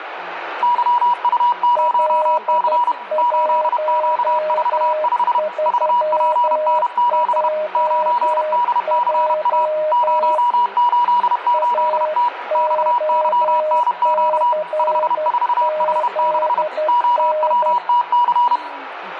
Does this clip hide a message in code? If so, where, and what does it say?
Yes: Morse code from 0.6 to 18.6 s, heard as two keyed tones, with radio static and speech in Russian. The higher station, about 31 wpm, 970 Hz: YU0C 8Q45 VPN7 9DCA 088T XYNQ 54H6 OWTC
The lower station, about 12 wpm, 620 Hz: L13JJ AOCZN